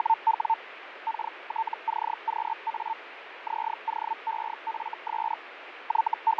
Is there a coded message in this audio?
Yes: Hellschreiber (Feld-Hell, 122.5 baud) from 0.0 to 6.4 s, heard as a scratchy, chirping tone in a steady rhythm, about 900 Hz, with radio static and fading. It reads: … KTCQA ZOEFS …